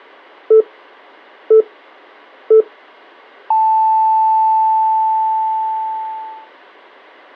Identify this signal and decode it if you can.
Radio time signal (three low pips and a long one an octave up, as on NHK), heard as pips.